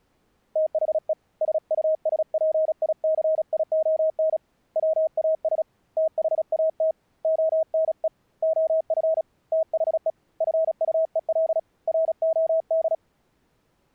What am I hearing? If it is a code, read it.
Morse code, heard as a keyed tone, hand-sent with a paddle, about 36 wpm, 640 Hz. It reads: THE SUSPICION WAS THAT ONE OF THE FUEL ROD